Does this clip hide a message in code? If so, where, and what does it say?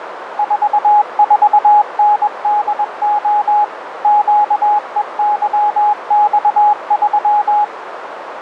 Yes: Morse code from 0.3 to 7.7 s, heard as a keyed tone, machine-sent, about 21 wpm, 840 Hz, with radio static and a narrow filter. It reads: 44NDO QEYX3